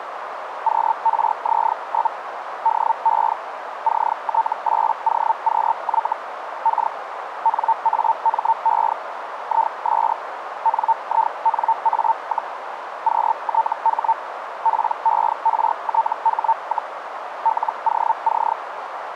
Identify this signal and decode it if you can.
Hellschreiber (Feld-Hell, 122.5 baud), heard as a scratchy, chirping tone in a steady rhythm, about 900 Hz, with radio static and a narrow filter. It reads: QRZ? DE CT8OQY K NAME IS NINA, QTH PERTH, LOC